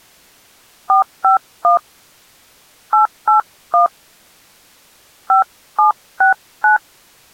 DTMF, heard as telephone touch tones, dialled by hand, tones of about 120 ms. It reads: 451 881 5769